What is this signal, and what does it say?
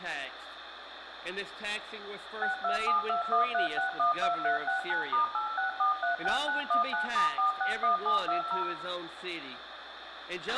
DTMF, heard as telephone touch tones, dialled by machine, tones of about 120 ms, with radio hiss, a squelch burst at the end and room echo. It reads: 627213612369*86436919*461720